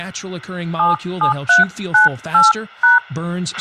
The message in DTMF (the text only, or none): 77398#